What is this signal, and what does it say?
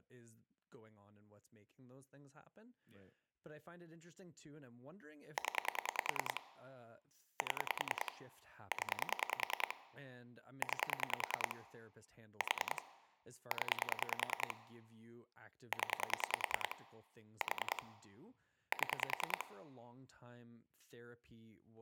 Pulse dialling, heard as clicks on a phone line, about 10 pulses a second, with speech in English. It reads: 0 7 0 9 4 0 0 4 7